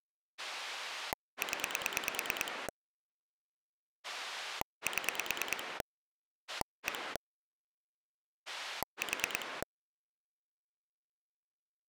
Pulse dialling, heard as a rotary dial, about 9 pulses a second. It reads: 0 7 1 4